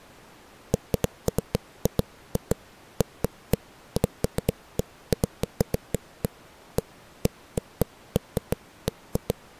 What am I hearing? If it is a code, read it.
Irregular knocks on a wall. There is no code.